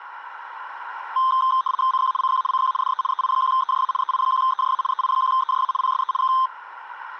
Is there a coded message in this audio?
Yes: RTTY (75 baud, 170 Hz shift) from 1.2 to 6.5 s, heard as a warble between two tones, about 1130 Hz centre, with radio static. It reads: CQ CQ CQ DE EI1EJA EI1EJA EI1EJA PSE K